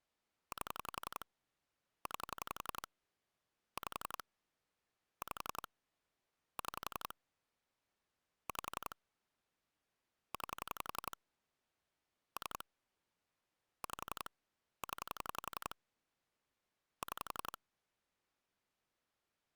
Pulse dialling, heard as clicks on a phone line, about 11 pulses a second. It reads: 8 9 5 5 6 5 9 3 5 0 6